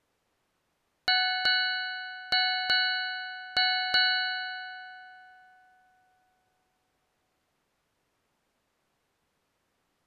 Ship's bell, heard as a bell. 6. Six half-hours of the watch have passed.